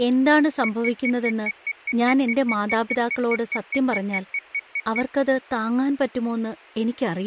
Evenly repeated beeps, with speech in Malayalam. There is no code.